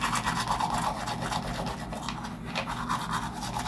The noise of a restroom. There is no code.